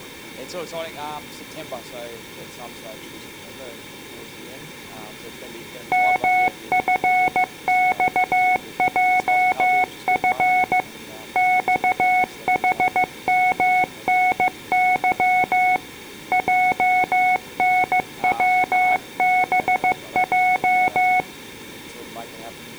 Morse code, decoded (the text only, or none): MFXJF XHMNY JNWBJ